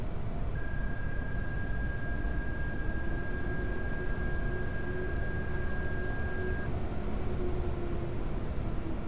PSK31 (31.25 baud), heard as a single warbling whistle, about 1600 Hz, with street noise.